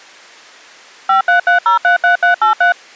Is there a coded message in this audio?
Yes: DTMF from 1.1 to 2.7 s, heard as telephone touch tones, dialled by machine, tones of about 120 ms. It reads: 533033383